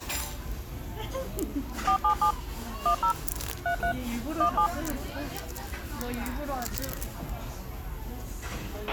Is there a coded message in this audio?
Yes: DTMF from 1.9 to 4.7 s, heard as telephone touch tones, dialled by machine, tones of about 90 ms, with a squelch burst at the end and the noise of a restaurant. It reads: 477 10 33 17